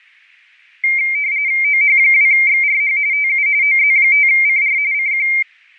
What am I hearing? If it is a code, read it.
RTTY (45.45 baud, 170 Hz shift), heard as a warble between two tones, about 2200 Hz centre. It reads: OH2XRH TU OZ5CR CQ